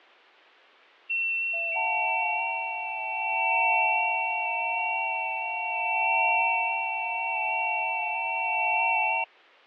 FT8 (several signals at once), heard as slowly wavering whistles, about 6.25 baud, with fading.